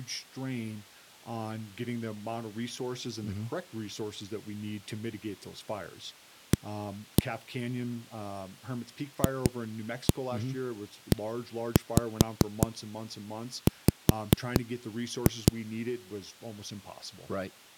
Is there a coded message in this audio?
Yes: tap code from 6.5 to 15.5 s, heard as knocks on a wall, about 4 knocks a second, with speech in English. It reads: A FEW